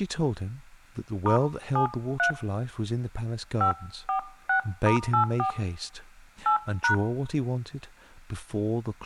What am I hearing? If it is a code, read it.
DTMF, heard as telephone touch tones, dialled by hand, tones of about 100 ms, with speech in English. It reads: *73 546*84 8#